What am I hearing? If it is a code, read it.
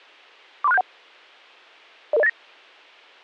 Five-tone selective call (EIA), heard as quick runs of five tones, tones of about 30 ms, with a squelch burst at the end. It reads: 43671 00089